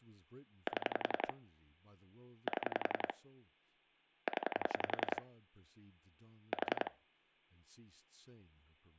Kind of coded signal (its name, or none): pulse dialling